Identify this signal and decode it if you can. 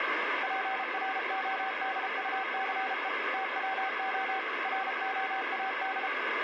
Morse code, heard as a keyed tone, machine-sent, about 33 wpm, 770 Hz, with radio static. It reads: PRODUCE TWO ROAD